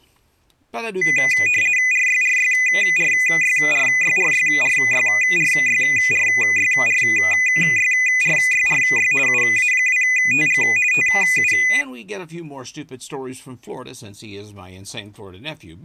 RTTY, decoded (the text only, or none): RYRYRYRYRYRYRYRYRYRYRY UA2TG TU